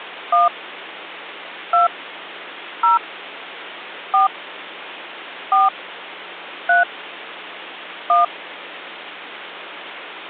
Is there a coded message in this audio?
Yes: DTMF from 0.3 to 8.2 s, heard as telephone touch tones, dialled by hand, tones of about 150 ms. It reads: 1 2 0 4 4 3 1